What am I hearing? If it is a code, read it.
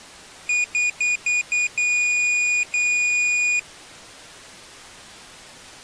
Beep code, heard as a piezo beeper, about 2450 Hz. 5 short, 2 long.